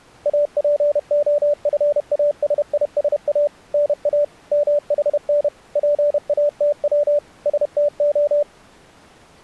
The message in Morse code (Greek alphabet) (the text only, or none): ΑΠΟΦΑΣΙΣΑ ΝΑ ΜΗΝ ΠΑΤΩ ΣΤΟ